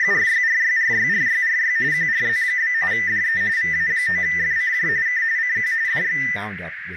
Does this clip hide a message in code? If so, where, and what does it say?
Yes: RTTY (45.45 baud, 170 Hz shift) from 0.0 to 6.4 s, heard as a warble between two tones, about 1900 Hz centre, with radio static, a narrow filter and speech in English. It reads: … QRZ? DE VA9FCJ K CQ DX